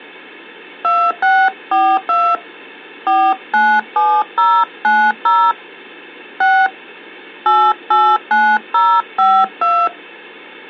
DTMF, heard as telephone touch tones, dialled by hand, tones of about 260 ms. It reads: 2642 497090 6 889052